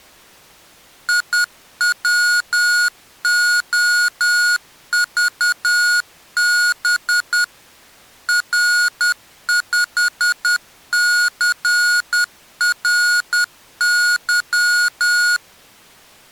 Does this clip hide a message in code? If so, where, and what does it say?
Yes: Morse code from 1.0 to 15.4 s, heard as electronic beeps, machine-sent, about 10 wpm, 1440 Hz. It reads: IWOVB R5CRY